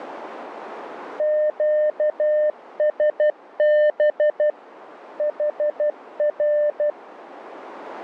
Morse code, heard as a keyed tone, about 12 wpm, 600 Hz, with radio static. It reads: QSB HR